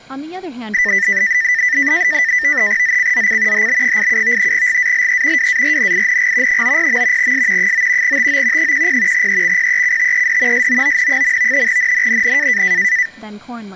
NAVTEX (SITOR-B), 100 baud, 170 Hz shift, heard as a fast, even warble, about 1900 Hz centre, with speech in English. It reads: ZCZC HB87 GALE WARNING 90. S 9 TO 10 EXPECTED SOON. NNNN